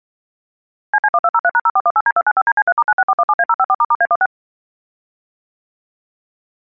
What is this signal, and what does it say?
DTMF, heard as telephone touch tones, dialled by machine, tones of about 50 ms. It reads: CC1203#0418D295DC3*96417A054**A16